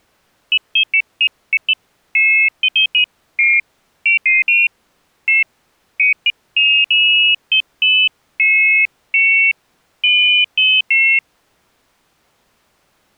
Pairs of high tones at irregular times. There is no code.